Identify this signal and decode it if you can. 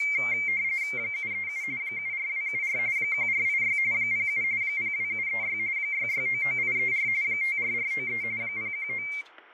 RTTY (45.45 baud, 170 Hz shift), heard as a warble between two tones, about 2200 Hz centre, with fading, static crashes and speech in English. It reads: 737 74274 1486 07 02736 6699834 54493 019